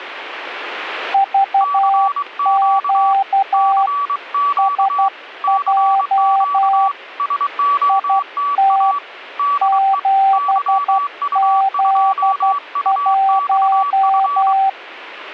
Morse code, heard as two keyed tones. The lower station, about 12 wpm, 780 Hz: VQ SJ IT 7Z1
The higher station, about 23 wpm, 1140 Hz: CQ CQ CQ SOTA DE YU2UXF